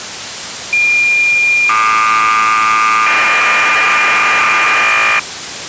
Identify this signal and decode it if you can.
Cassette data (Kansas City type), 1200 baud, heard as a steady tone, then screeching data, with tape hiss.